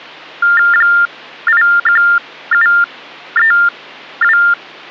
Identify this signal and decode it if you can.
TTY/TDD text telephone tones (45.45 baud Baudot), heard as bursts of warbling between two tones, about 400 Hz shift, 1600 Hz centre. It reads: 81732